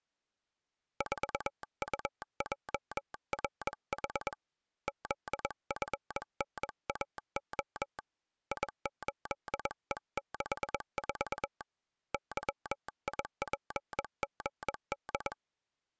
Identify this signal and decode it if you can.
Morse code, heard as a telegraph sounder, hand-sent with a paddle, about 21 wpm. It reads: 4UJRH ZFNAO I8E64 YIPGD